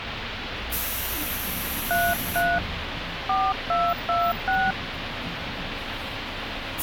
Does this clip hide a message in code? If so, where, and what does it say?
Yes: DTMF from 1.9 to 4.7 s, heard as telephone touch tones, dialled by hand, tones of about 230 ms, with phone line noise and the noise inside a bus. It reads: 33 4226